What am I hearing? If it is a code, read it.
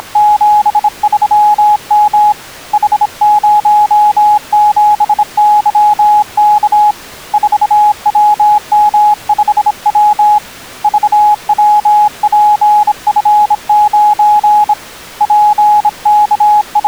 Morse code, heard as a keyed tone, hand-sent with a bug key, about 26 wpm, 840 Hz. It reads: … H07YK 4WM5W VWPF9 …